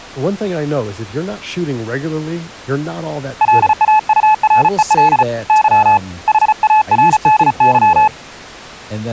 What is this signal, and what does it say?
Morse code, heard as a keyed tone, hand-sent with a paddle, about 35 wpm, 860 Hz, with speech in English. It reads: LAUREL Y HARDY